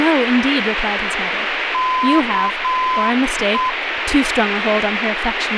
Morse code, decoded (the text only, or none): KE